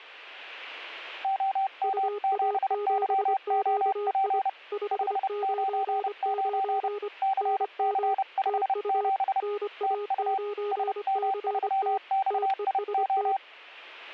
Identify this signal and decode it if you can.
Morse code, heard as two keyed tones, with static crashes. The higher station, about 30 wpm, 780 Hz: OM7YOP 599 CC57 TU SM3XIO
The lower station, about 25 wpm, 410 Hz: UA7QI 599 NM TU NA9CT TEST